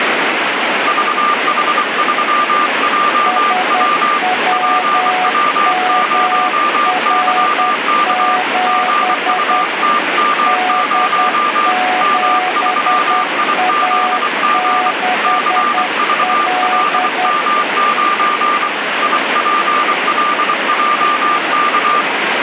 Morse code, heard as two keyed tones, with radio static. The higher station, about 24 wpm, 1190 Hz: VH3JW PW0YK GUTM0 M3IZG CVLM9 IPLJK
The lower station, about 10 wpm, 740 Hz: SWMR7 D7A6L